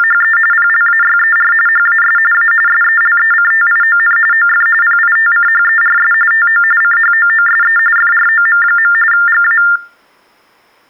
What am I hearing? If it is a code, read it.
TTY/TDD text telephone tones (45.45 baud Baudot), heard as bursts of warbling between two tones, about 400 Hz shift, 1600 Hz centre. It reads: … PLAYER HAS A SELECTION OF PITCHERS TO CHOOSE FROM. GA